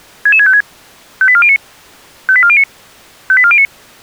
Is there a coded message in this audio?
Yes: five-tone selective call (ZVEI) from 0.3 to 3.7 s, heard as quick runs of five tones, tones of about 70 ms. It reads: 66656 58409 58409 58409